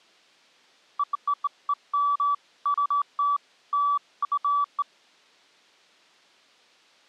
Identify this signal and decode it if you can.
Beeps of irregular length. There is no code.